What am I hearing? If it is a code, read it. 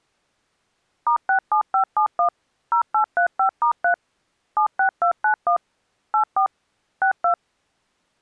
DTMF, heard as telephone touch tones, dialled by machine, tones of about 100 ms. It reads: *67571 0835*3 76291 84 62